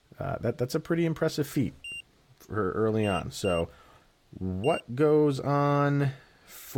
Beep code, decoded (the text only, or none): 1-2-1